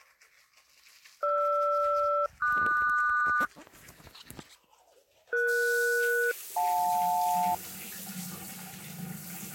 Aircraft SELCAL, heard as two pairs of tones, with the noise of a restroom. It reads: GR-QS ES-JL